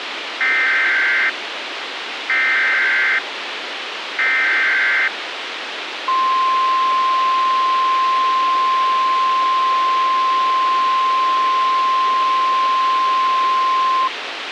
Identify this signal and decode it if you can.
Emergency Alert System (SAME) tones (header bursts, then the 1050 Hz attention tone), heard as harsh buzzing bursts, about 520.83 baud, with radio hiss.